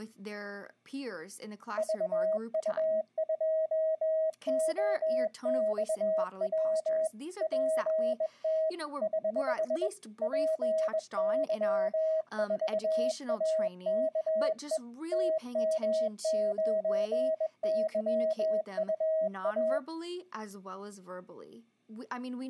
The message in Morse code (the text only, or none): VU2OXW PT <HH> PY4AKE TM9YUA